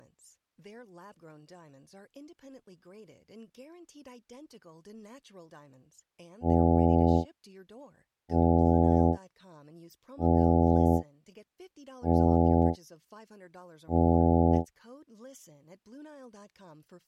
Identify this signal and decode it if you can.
Ship horn signal, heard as a ship's horn, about 80 Hz, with speech in English. 5 short. At sea: I doubt that you are doing enough to avoid a collision.